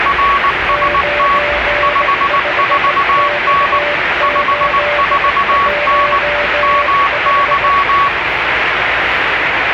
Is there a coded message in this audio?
Yes: Morse code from 0.0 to 8.1 s, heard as two keyed tones, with radio static and the noise inside a subway train. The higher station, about 19 wpm, 1120 Hz: RST 54N 54N MY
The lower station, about 18 wpm, 590 Hz: 95X815